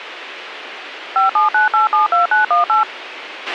DTMF, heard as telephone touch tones, dialled by machine, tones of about 140 ms, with radio hiss and a squelch burst at the end. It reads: 579872918